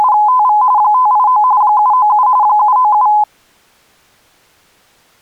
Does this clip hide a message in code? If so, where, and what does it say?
Yes: RTTY (45.45 baud, 170 Hz shift) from 0.0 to 3.2 s, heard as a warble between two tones, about 930 Hz centre. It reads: … 589 797 797